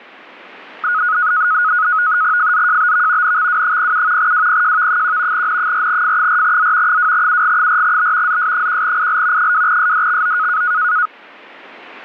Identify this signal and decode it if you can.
NAVTEX (SITOR-B), 100 baud, 170 Hz shift, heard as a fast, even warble, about 1360 Hz centre. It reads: FZJBV NXW07 WPJV1 N4F4Z 2UG4B ZS1IL 2SDXO